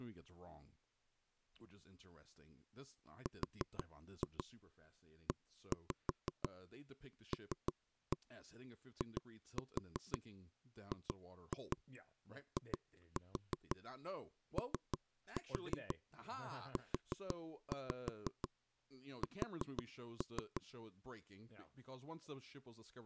Tap code, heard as knocks on wood, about 6 knocks a second, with speech in English. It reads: RELIGIOUS